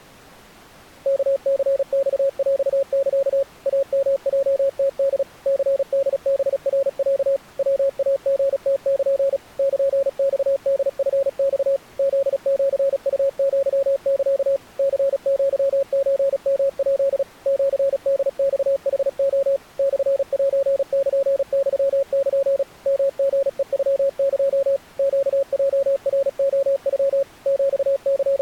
Morse code (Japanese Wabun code), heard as a keyed tone, machine-sent, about 36 wpm, 550 Hz. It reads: ワニマヰサ イヨヲムホ ニホハナロ ヤイリムル ルマホチマ フシウアサ ニアソヨヱ シホマヌレ モセルユル ヨリヘノエ ネヲナレノ …